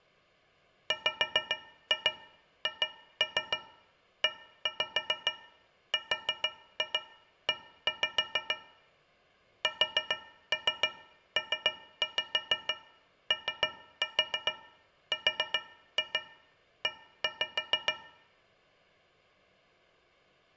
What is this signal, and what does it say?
Tap code, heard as taps on a metal pipe, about 6 knocks a second. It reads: WHERE SPORE